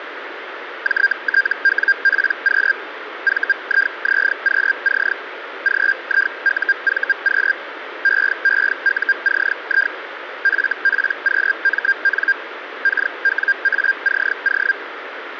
Hellschreiber (Feld-Hell, 122.5 baud), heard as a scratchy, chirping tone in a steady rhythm, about 1600 Hz, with radio static. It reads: JTWPQ VIZQC GIUVQ EEUCI FPQMN KWACO